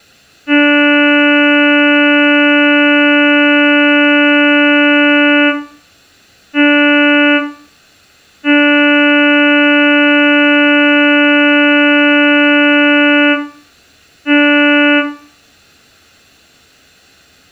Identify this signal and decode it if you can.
Ship horn signal, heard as a ship's horn, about 290 Hz, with room echo. 1 long, 1 short, 1 long, 1 short. At sea: I agree to be overtaken.